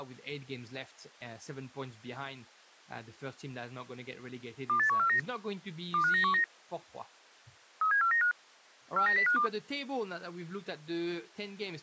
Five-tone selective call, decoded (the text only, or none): 28149 25919 37495 49052